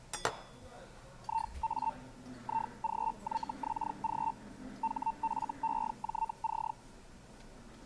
Hellschreiber (Feld-Hell, 122.5 baud), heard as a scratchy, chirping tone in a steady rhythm, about 900 Hz, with the noise of a restaurant. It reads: IA IGYXG HFEJC